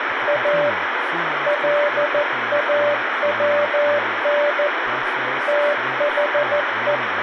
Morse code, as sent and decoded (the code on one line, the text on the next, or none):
.- / .-.. .- .-- -. / - .... .
A LAWN THE